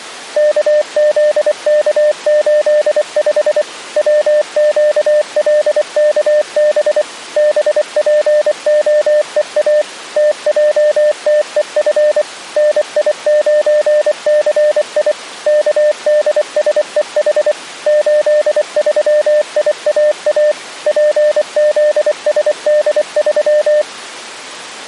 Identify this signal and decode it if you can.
Morse code, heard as a keyed tone, machine-sent, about 24 wpm, 600 Hz. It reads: KZK85 WQLKB BPOEA TJTEF NI9CI KDSEH 83IAA PZSD3